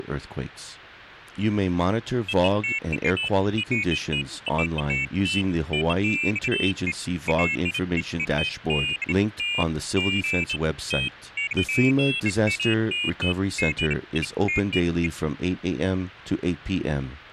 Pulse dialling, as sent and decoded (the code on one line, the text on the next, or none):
none